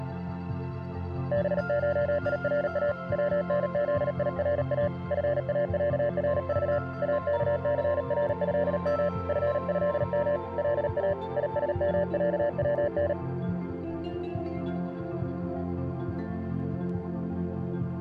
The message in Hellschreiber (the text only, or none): none